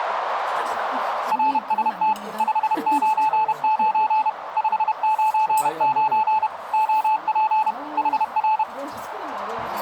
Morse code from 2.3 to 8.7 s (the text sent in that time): 599 599 OP HR